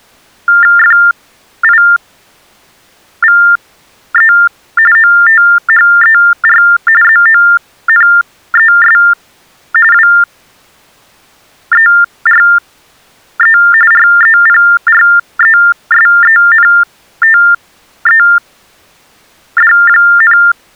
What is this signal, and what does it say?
TTY/TDD text telephone tones (45.45 baud Baudot), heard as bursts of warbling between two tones, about 400 Hz shift, 1600 Hz centre. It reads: FIVE OTHER ZONES WERE REPRESENTED,